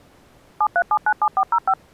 DTMF, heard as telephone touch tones, dialled by machine, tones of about 60 ms. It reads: 73797405